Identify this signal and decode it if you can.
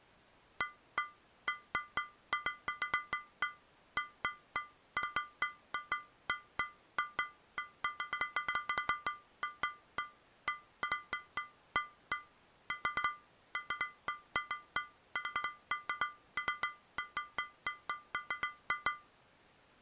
Irregular taps on a metal pipe. There is no code.